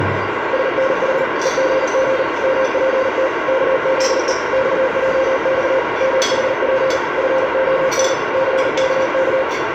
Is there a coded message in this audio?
Yes: Morse code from 0.5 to 9.5 s, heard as a keyed tone, machine-sent, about 39 wpm, 530 Hz, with heavy radio static and the noise of a crowd indoors. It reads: SNH EGG MPT KZE XJX MHP FON CKK